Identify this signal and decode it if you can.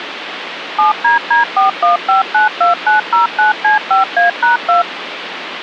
DTMF, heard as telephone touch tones, dialled by machine, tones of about 140 ms, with phone line noise. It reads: 7DD41592909C5A#2